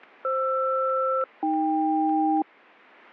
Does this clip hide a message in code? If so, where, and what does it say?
Yes: aircraft SELCAL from 0.2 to 2.4 s, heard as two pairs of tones. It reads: FR-AK